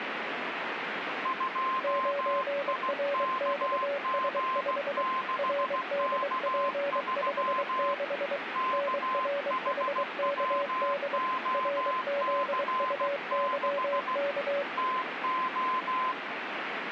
Morse code, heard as two keyed tones, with radio static. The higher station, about 16 wpm, 1040 Hz: 2IKG6K3 KHWOC6 TO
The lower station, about 23 wpm, 570 Hz: 9RXS5 RDP56 NRHKD RZUYK